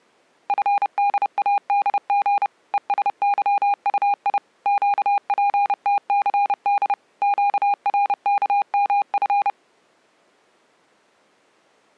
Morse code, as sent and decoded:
..-. -.. .- -.. --. / . ... -.-- ..- .. / --.- .--. - -.-. -.. / --.- .-. -.- -- ..-.
FDADG ESYUI QPTCD QRKMF

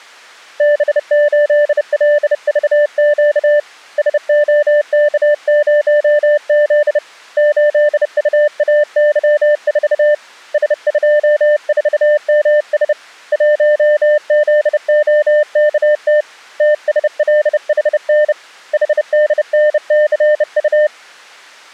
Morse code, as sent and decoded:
-... ---.. .-.. ...- --.- / ... --- -.- ----- --.. / ---.. ..- .- -.-- ....- / ... ..--- ....- -- ... / .---- --.. --- -.- - / - ... .-.. .... -. / .... -.. -. -.-. ..-
B8LVQ SOK0Z 8UAY4 S24MS 1ZOKT TSLHN HDNCU

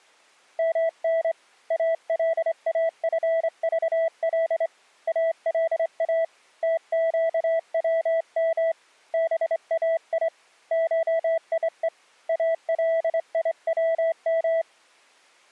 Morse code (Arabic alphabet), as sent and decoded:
-- -. / .- .-.. .- ..-. ...- .-.. / .- .-.. .- / - --.- .-- -- / -... .- .. / ---- .. . / .- .-.. .. .-- --
من الافضل الا تقوم باي شيء اليوم

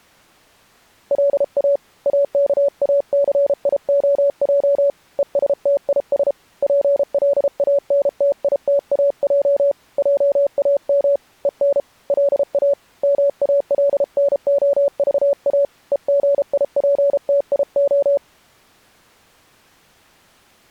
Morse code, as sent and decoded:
.-.. .- / .- -.- .- -.-. .. --- .--- / . ... - .. ... / .--. .-.. .- -. - .. - .- .--- / .--- .- -- / . -. / .-.. .- / -- .- .-.. -. --- ...- .- / . --. .. .--. - .. ---
LA AKACIOJ ESTIS PLANTITAJ JAM EN LA MALNOVA EGIPTIO

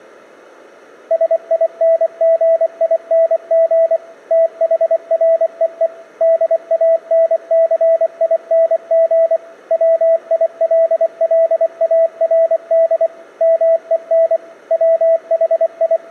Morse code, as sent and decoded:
... .. -. --. .. -. --. / - .... .-. . . / -.. .- -. -.-. .. -. --. / .-- .. .-.. .-.. .- .-. -.. / -- . -. / …
SINGING THREE DANCING WILLARD MEN …

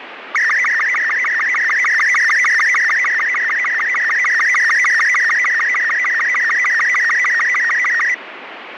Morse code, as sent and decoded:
none

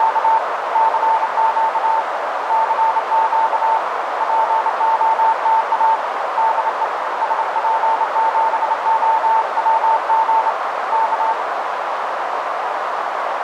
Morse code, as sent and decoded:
… / -.-. --.- / -.-. --.- / .--. --- - .- / -.. . / ... .--. --... --- .-- --. / -.-
… CQ CQ POTA DE SP7OWG K

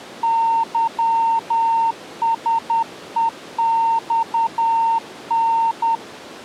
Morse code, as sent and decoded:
-.-- ... . -..- -.
YSEXN

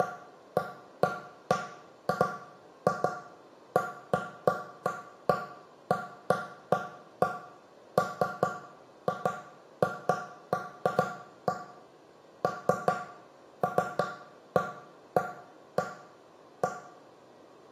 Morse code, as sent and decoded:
none

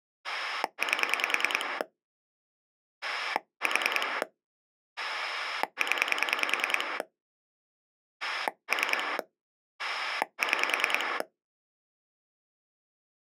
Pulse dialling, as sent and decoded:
8 / 4 / 10 / 3 / 6
8 4 0 3 6

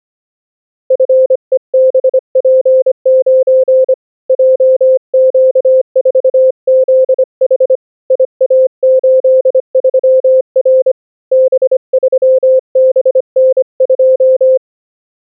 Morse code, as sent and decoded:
..-. . -... .--. ----. / .--- --.- ....- --.. .... / .. .- ---.. ...-- .-. / -... ...-- -... -. ..---
FEBP9 JQ4ZH IA83R B3BN2

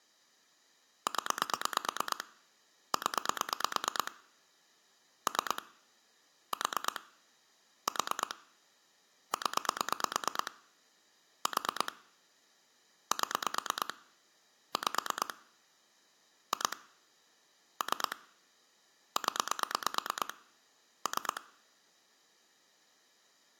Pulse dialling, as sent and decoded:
10 / 10 / 3 / 4 / 4 / 10 / 4 / 7 / 5 / 2 / 3 / 10 / 3
0 0 3 4 4 0 4 7 5 2 3 0 3

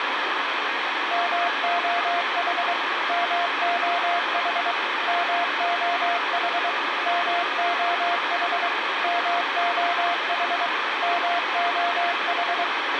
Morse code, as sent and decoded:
-- --- .... / -- --- .... / -- --- .... / -- --- .... / -- --- .... / -- --- ....
MOH MOH MOH MOH MOH MOH

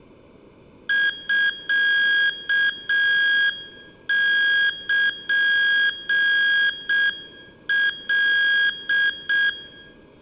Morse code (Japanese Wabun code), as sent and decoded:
..-.- -.--. .-..
ミルカ

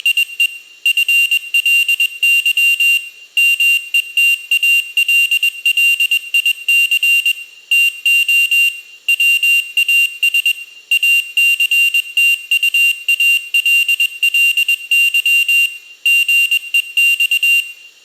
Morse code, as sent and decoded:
… / ..-. .-.. -.-- / -- . - .- .-.. .-.. .. -.-. / - --- / .-- .- ... / .- -.-. - ..- .- .-.. .-.. -.-- / --. . -..-
… FLY METALLIC TO WAS ACTUALLY GEX

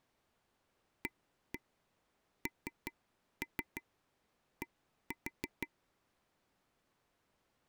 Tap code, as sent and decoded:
1-1 3-3 1-4
AND

